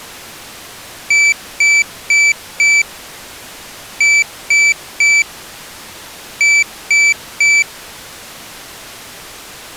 Beep code, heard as a piezo beeper, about 2300 Hz. 4-3-3. In Phoenix BIOS tables: timer channel 2 failure.